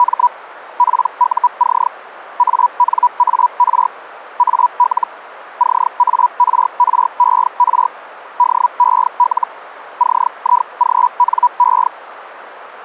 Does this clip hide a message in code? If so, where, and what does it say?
Yes: Hellschreiber (Feld-Hell, 122.5 baud) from 0.0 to 11.9 s, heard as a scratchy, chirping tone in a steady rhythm, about 980 Hz. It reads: … PUC ANAR AL CARRER DEL CIGNE